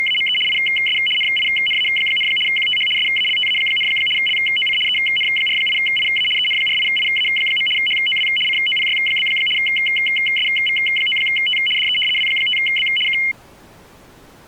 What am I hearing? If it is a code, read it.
RTTY (75 baud, 850 Hz shift), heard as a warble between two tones, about 2550 Hz centre. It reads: … IS NINA, QTH SALTA, LOC EN48IA EN48IA. HOW COPY? SV9T DE W5B K